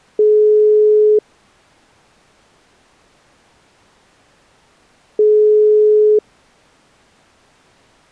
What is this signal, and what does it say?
Telephone call progress tone (single-tone plan, as in most of Europe), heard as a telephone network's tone, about 420 Hz, 1 s on and 4 s off. Ringback tone.